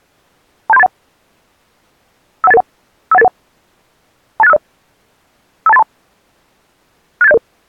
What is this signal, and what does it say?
Five-tone selective call (EIA), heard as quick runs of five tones, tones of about 30 ms. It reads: 27381 51881 51881 28650 52832 68700